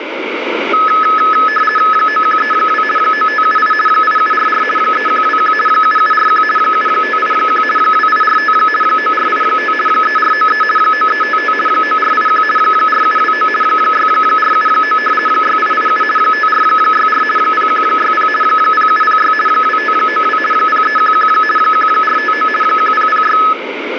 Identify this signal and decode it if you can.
RTTY (50 baud, 450 Hz shift), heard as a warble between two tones, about 1500 Hz centre, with radio static. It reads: 9132 9578 8744 3121 7741 7581 2845 9485 3493 9355 9481 4729 6479 6887 5464 0160 0706 2592 0311 1459 1006